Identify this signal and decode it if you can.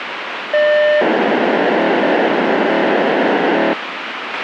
POCSAG pager data (1200 baud), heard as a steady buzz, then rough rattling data, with radio hiss and a squelch burst at the end.